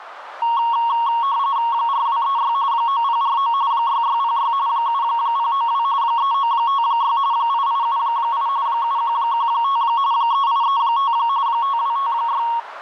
RTTY (45.45 baud, 170 Hz shift), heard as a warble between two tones, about 1020 Hz centre, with radio static and a narrow filter. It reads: 4236 9049 6606 7092 3956 8878 7115 3835 5256